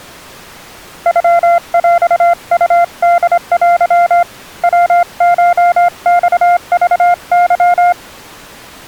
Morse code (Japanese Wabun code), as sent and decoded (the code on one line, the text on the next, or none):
..-- .-..- ..- -.. .-.-- / .-- ---- -..- ...- -.--
ノヰウホテ ヤコマクケ